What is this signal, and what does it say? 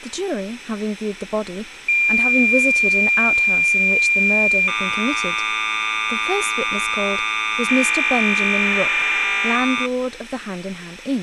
Cassette data (Kansas City type), 1200 baud, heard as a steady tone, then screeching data, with speech in English.